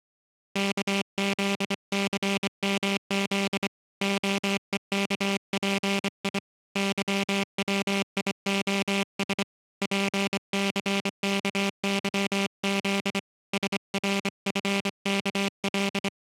Morse code, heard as a buzzer, hand-sent with a straight key, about 25 wpm. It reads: KZCMZ OEKPI YWIOS PCKYZ SRFKL